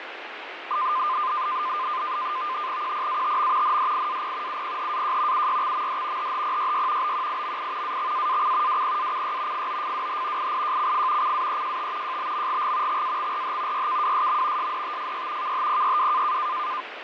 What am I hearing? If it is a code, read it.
NAVTEX (SITOR-B), 100 baud, 170 Hz shift, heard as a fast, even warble, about 1120 Hz centre, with radio static and fading. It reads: QPATM NDIAP UPHAJ UYXMD HHPYY BQIMI AXAAC WPACY FOFWH IIJCF CAEJT JBMGG XAXRH YKWSM SDTFY KHPYW